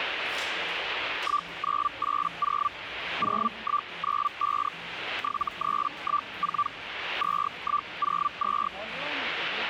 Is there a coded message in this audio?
Yes: Hellschreiber (Feld-Hell, 122.5 baud) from 1.2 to 8.7 s, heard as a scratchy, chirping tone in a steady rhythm, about 1170 Hz, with radio static and the noise of a crowd indoors. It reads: 1980 0195 7314 2102